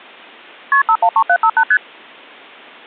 Multi-frequency trunk signalling (R1, as on North American trunks), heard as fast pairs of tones, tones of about 70 ms. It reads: KP 513758 ST